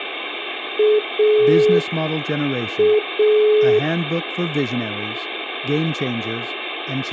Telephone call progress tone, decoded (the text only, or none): dial tone